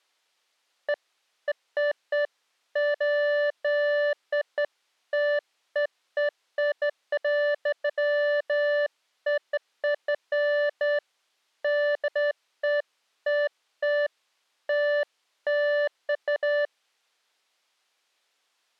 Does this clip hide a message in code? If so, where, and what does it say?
No, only beeps of irregular length.